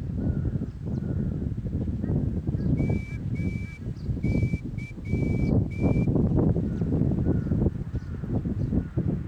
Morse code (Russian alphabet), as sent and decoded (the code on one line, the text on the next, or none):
-- -.--
МЫ